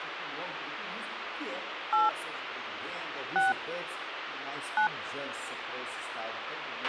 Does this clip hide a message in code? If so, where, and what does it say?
Yes: DTMF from 1.9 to 4.9 s, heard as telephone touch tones, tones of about 140 ms, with radio hiss and a squelch burst at the end. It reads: 8 6 9